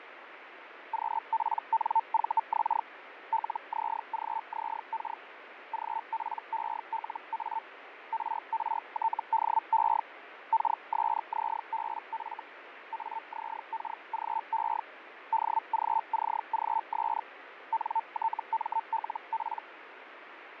Hellschreiber (Feld-Hell, 122.5 baud), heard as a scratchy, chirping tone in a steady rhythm, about 900 Hz, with radio static and fading. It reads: QPNVX LZGZK GPELA RRTDE KSZBF AZKGE DGCGS NTMLP